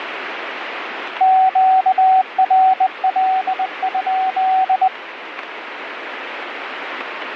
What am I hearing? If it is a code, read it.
Morse code, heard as a keyed tone, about 20 wpm, 760 Hz, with radio static. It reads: QRL?